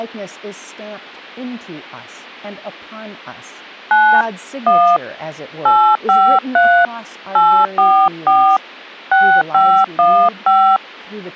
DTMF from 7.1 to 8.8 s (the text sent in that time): 844